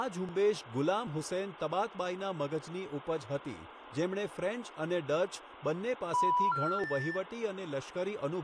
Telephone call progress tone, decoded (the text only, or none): special information tone